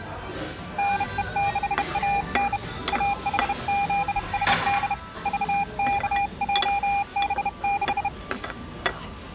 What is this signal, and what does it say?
Morse code, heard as a keyed tone, hand-sent with a bug key, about 31 wpm, 800 Hz, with the noise of a restaurant. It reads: NE6AN AHZSD VKJB6